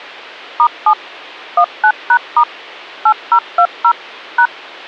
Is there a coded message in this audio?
Yes: DTMF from 0.6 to 4.5 s, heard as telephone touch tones, dialled by machine, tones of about 70 ms. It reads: *7 19#* 8020 #